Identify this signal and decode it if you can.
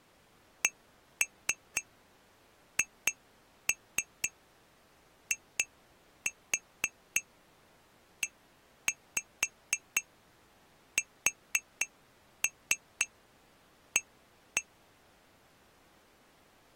Tap code, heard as taps on glass, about 4 knocks a second. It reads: CHIESA